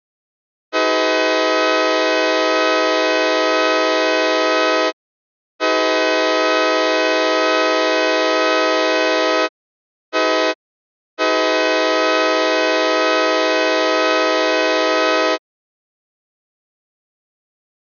Train horn signal, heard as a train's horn. 2 long, 1 short, 1 long. On North American railways: approaching a public crossing.